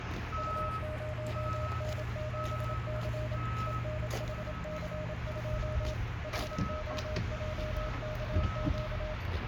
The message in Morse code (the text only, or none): U0N7C ENHC2 HOJKQ